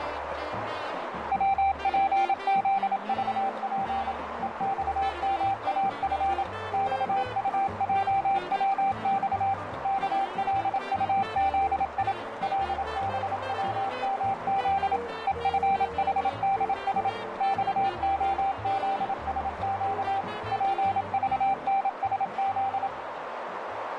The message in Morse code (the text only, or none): WPZVP EXMAF XUJWX KLUZI LBWMZ EFHDS XOZSQ PVNSZ